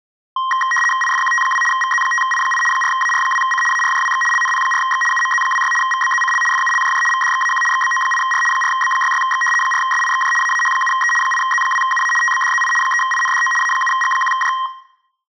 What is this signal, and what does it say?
RTTY (75 baud, 850 Hz shift), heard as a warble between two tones, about 1480 Hz centre, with room echo. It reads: IFQT2 VZ5I8 4AR2C ARJWX LNP4X UMZ26 VBZCL FULJJ VDXAQ XBO8R 4B66X 4SIXJ AAH7E 8Z2UA TBDZI 3INDO A7G1J